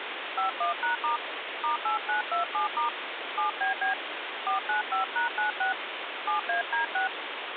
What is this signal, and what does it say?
DTMF, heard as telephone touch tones, dialled by hand, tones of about 120 ms, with phone line noise. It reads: 51#* *8927* 7BB 495#96 7AD6